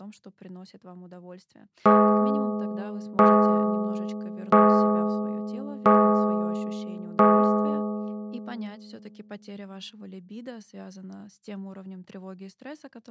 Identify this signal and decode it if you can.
Clock strike, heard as a bell, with speech in Russian. 5. Five o'clock.